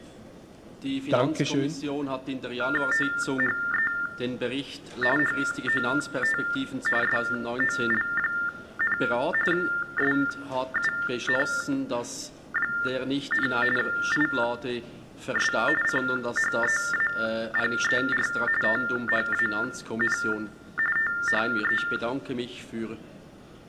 TTY/TDD text telephone tones (45.45 baud Baudot), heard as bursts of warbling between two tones, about 400 Hz shift, 1600 Hz centre. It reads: THE HOT SOL, SUN, IS CHEAPER THAN THE